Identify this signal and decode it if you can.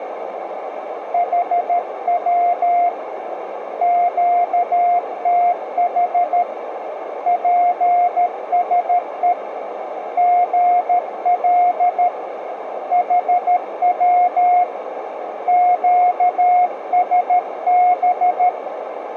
Morse code, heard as a keyed tone, hand-sent with a paddle, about 13 wpm, 710 Hz, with radio static and a narrow filter. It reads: HW QTH PSE GL HW QSB